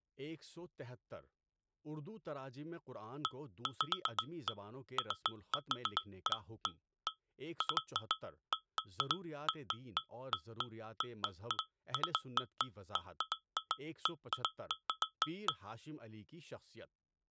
Irregular taps on glass, with speech in Urdu. There is no code.